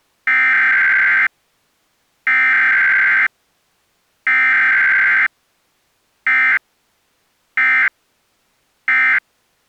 Emergency Alert System (SAME) tones (header bursts, then end-of-message bursts), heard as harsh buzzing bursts, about 520.83 baud.